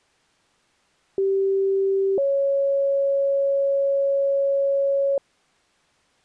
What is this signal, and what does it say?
Two-tone page, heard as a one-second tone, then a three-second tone, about 390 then 550 Hz.